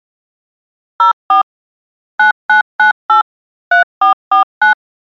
DTMF, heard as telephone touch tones, dialled by machine, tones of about 120 ms. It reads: 04 9998 3449